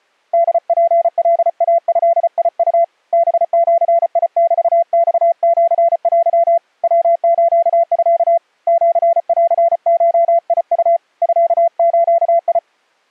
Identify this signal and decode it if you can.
Morse code (Japanese Wabun code), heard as a keyed tone, hand-sent with a paddle, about 34 wpm, 680 Hz. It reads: ホツカイドウ ハジメマシテ ヤスミ シンゴウ ミズ